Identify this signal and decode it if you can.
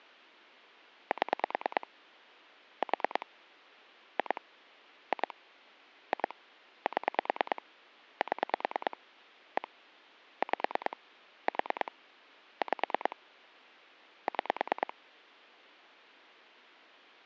Pulse dialling, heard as clicks on a phone line, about 9 pulses a second. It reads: 7 4 2 2 2 7 7 1 5 4 5 6